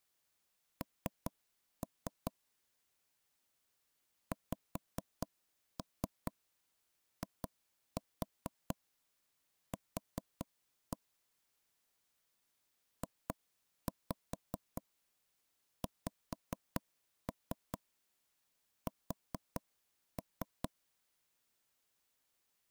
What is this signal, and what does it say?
Tap code, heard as knocks on wood, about 4 knocks a second. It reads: N XIQ JXS